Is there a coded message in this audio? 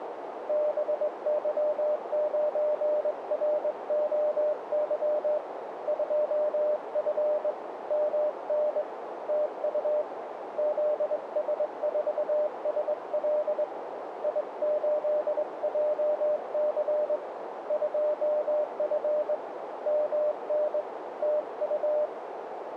Yes: Morse code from 0.4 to 22.1 s, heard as a keyed tone, hand-sent with a straight key, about 22 wpm, 600 Hz, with radio static and a narrow filter. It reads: BY9ROY 2F MN TU ZS4SL I8JC 2F MN TU